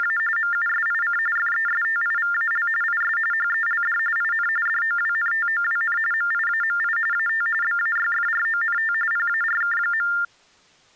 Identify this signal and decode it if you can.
TTY/TDD text telephone tones (45.45 baud Baudot), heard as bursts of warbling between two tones, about 400 Hz shift, 1600 Hz centre. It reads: … MUSIC FESTIVAL IS HELD IN DOWNTOWN MIAMI AT BAYFRONT PARK.